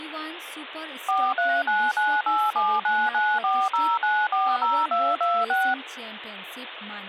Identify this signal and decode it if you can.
DTMF, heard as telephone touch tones, dialled by machine, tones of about 240 ms, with phone line noise and speech in Nepali. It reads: 4399879940940226